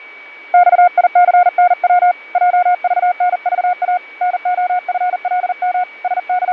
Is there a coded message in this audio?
Yes: Morse code (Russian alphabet) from 0.5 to 6.5 s, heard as a keyed tone, hand-sent with a paddle, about 40 wpm, 720 Hz, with fading and a steady whistle near 2270 Hz. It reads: ЬИЦНВ ЙЖНЖА НОФЛМ …